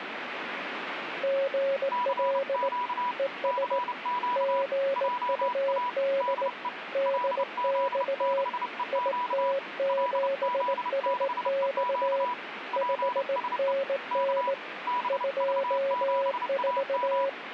Morse code, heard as two keyed tones, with radio static. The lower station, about 18 wpm, 550 Hz: GL ES GUD DX IT7SX 5NN 24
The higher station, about 30 wpm, 980 Hz: CQ CQ JA DE LZ6EQ LZ6EQ PSE K BV7AM